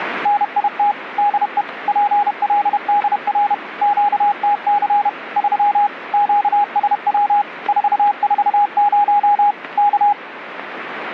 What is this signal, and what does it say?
Morse code, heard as a keyed tone, machine-sent, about 31 wpm, 820 Hz, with radio static. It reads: NIT DE PLDR QTC 3 QSW 440 K